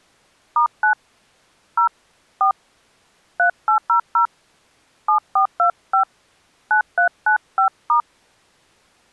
DTMF, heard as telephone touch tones, dialled by hand, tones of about 100 ms. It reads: *9 0 4 3800 7425 9395*